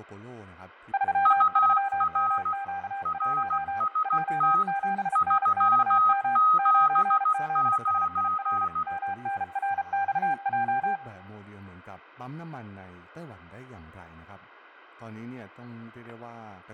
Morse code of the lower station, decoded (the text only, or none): 33MQ1 J7NXM 9ZSIR MNRXJ